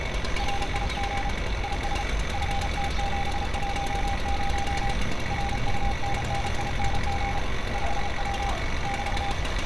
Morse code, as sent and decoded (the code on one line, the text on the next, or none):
.-. .. --. / .. ... / ..-. - --... .---- ----- / .-. ..- -. -. .. -. --. / ..... .-- / -...-
RIG IS FT710 RUNNING 5W <BT>